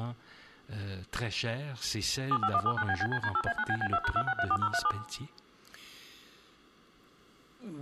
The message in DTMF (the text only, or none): 75179BBCD8A9BB2#2634037